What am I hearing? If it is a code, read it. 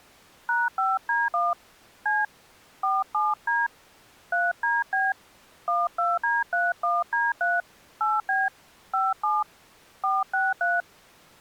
DTMF, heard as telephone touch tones, dialled by hand, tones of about 200 ms. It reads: #5D1 C 47D 3DB 12D31D3 8B 57 463